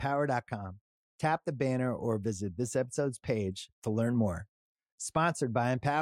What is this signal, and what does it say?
Speech in English. There is no code.